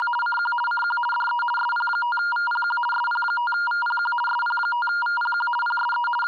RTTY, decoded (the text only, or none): … CQ CQ DE SP5VPQ SP5VPQ SP5VPQ PSE …